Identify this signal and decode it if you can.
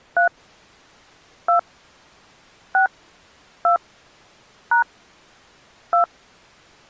DTMF, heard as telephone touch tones, dialled by hand, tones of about 110 ms. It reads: 3 2 6 2 # 2